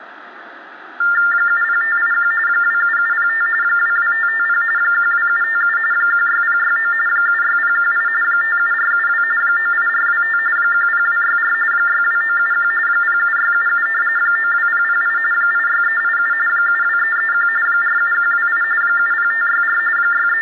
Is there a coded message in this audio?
Yes: TTY/TDD text telephone tones (45.45 baud Baudot) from 1.0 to 20.4 s, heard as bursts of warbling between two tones, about 400 Hz shift, 1600 Hz centre, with phone line noise and room echo. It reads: 70581 27705 22550 12757 16069 76018 57472 98425 10264 62971 07677 92008 86387 72331 47128 70564 …